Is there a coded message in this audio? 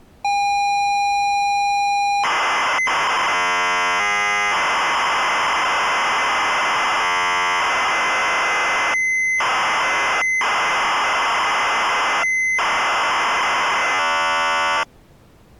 Yes: ZX Spectrum tape loading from 0.2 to 14.8 s, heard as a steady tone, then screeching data.